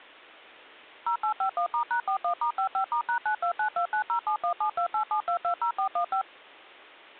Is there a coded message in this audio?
Yes: DTMF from 1.1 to 6.2 s, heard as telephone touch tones, dialled by machine, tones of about 90 ms. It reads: 0851*#41*55*#929290717287220415